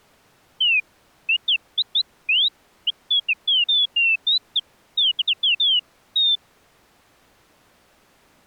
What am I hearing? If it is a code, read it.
Bird-like chirps. There is no code.